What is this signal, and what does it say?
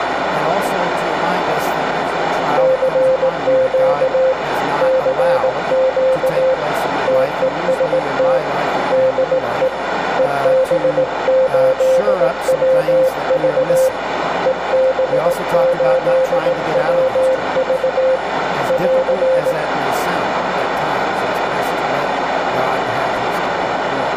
Morse code, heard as a keyed tone, hand-sent with a straight key, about 18 wpm, 520 Hz, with radio static, a narrow filter and room echo. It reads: CQ CQ TEST DE EB8WV EB8WV <AR>